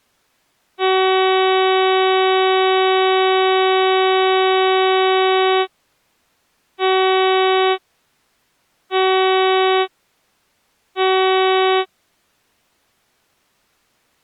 Ship horn signal, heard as a ship's horn, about 380 Hz. 1 long, 3 short. At sea: a vessel under tow in fog.